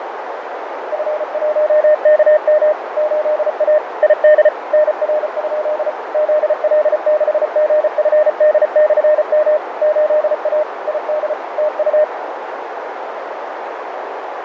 Morse code, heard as a keyed tone, machine-sent, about 34 wpm, 610 Hz, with radio static, fading and a narrow filter. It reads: F1KM 8A ID NR? ZL6GFD/M 8A ID TU